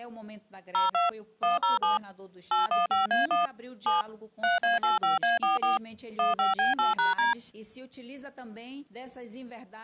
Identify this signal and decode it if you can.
DTMF, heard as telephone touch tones, dialled by machine, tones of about 150 ms. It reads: 02 107 815A1 7 3A85A44 15B8#D